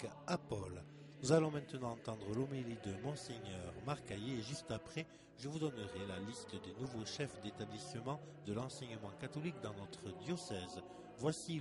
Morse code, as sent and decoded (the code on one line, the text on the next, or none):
none